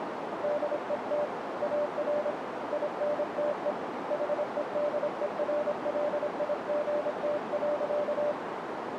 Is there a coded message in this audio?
Yes: Morse code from 0.4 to 8.4 s, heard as a keyed tone, hand-sent with a paddle, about 26 wpm, 590 Hz, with radio static and a narrow filter. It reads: DET AR INTE HEDERLIGT.